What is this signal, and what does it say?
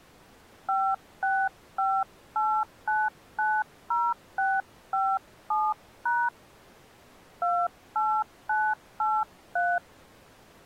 DTMF, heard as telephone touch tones, dialled by hand, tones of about 230 ms. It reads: 5658990657# 28983